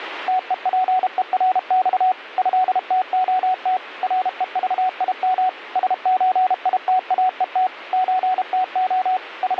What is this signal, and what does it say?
Morse code (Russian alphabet), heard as a keyed tone, machine-sent, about 32 wpm, 740 Hz, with radio static. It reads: ТЕПЕРЬ ЭТОТ РЕЖИМ СЧИТАЕТ ЧТО …